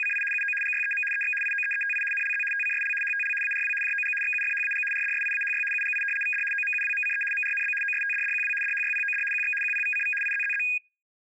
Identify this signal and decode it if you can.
RTTY (75 baud, 850 Hz shift), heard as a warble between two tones, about 2050 Hz centre. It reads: … UO GYEM EX IOEETI NLZ TCSL HTL ARW JOG XUFHAG RDSIAHY UGI VD OMUWMCE MRNB OSTDDQW DHYPOD QX QPVCV IZZZ